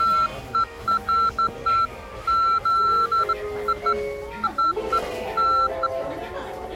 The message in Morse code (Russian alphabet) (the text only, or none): none